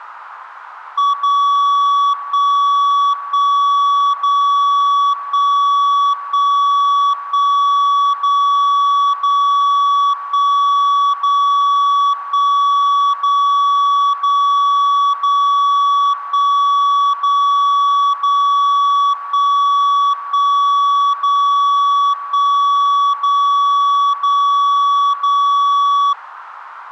Radio time signal (DCF77), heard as a tone whose level steps once a second, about 1140 Hz, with radio static. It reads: 0 1 1 0 1 1 1 0 0 1 0 1 0 0 0 1 0 0 1 1 0 1 0 0 0